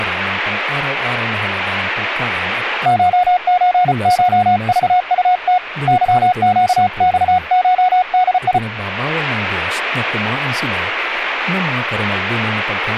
Morse code (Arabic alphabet), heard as a keyed tone, hand-sent with a paddle, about 34 wpm, 730 Hz, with speech in Filipino. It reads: شزشضطت ظقصشدي